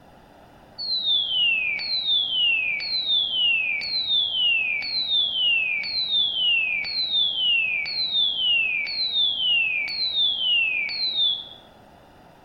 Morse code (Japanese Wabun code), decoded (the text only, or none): none